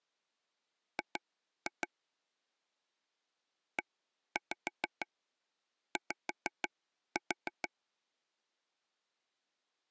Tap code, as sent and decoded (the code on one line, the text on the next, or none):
2-2 / 1-5 5-4
G EY